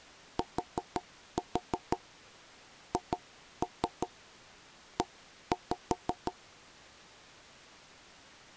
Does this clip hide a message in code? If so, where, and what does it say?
Yes: tap code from 0.4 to 6.4 s, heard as knocks on wood, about 5 knocks a second. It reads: THE